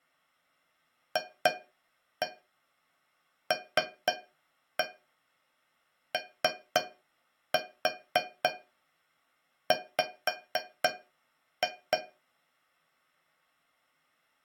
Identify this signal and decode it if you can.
Tap code, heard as taps on a metal pipe, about 3 knocks a second. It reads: FLOW